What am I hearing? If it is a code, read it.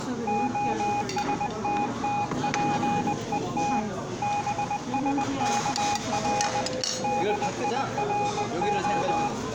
Morse code (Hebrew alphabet), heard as a keyed tone, hand-sent with a bug key, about 20 wpm, 820 Hz, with the noise of a restaurant. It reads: השתתפות בשכר דירה